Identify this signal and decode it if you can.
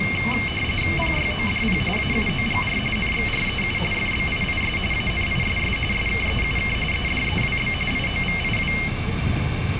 RTTY (45.45 baud, 850 Hz shift), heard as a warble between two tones, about 2550 Hz centre, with radio static and the noise inside a bus. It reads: PYODP AUOGR NXREU FBIIS ANISS SKEUK EDEWB IOVIW